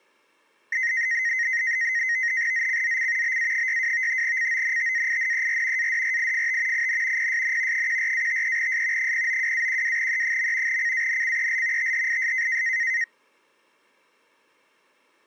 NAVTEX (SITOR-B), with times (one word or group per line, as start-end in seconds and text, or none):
2.5-3.4 ZCZC
3.2-4.2 BA62
4.2-5.9 CONTAINER
5.8-6.9 ADRIFT
6.7-7.3 IN
7.2-7.9 PSN
7.7-9.1 14-53S
9.0-10.8 092-12E.
10.7-11.9 CANCEL
11.8-12.6 THIS